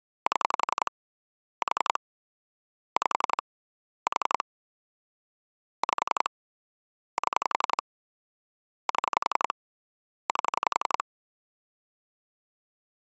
Pulse dialling, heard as clicks on a phone line, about 11 pulses a second. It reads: 7 4 5 4 5 7 7 8